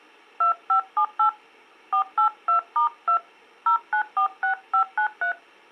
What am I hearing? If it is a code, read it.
DTMF, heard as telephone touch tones, dialled by hand, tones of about 100 ms. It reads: 2578 482*2 0946593